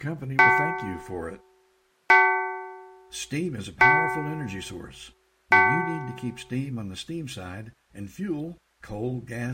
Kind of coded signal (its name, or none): clock strike